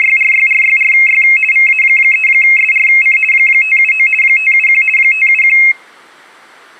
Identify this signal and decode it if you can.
RTTY (50 baud, 450 Hz shift), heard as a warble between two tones, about 2350 Hz centre, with room echo. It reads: … VA3SRC 579 571 571